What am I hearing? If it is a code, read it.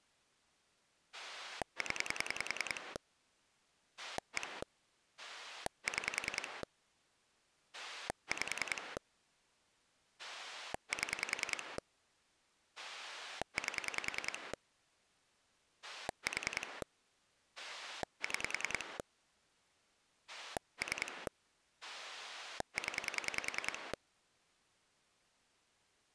Pulse dialling, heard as a rotary dial, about 10 pulses a second. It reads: 0 1 6 5 7 8 4 6 3 0